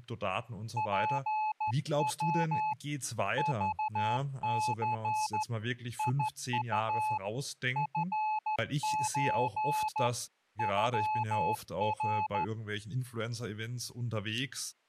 Morse code (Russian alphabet), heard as a keyed tone, hand-sent with a straight key, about 13 wpm, 860 Hz, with speech in German. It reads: ПВ ЖЦ ИУ ФЧ ЮР